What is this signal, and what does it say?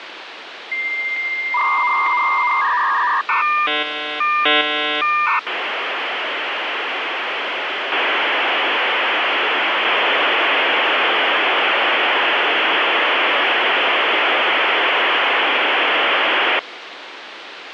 Dial-up modem handshake (V.34 or later), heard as a whistle, warbles, then hiss, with phone line noise.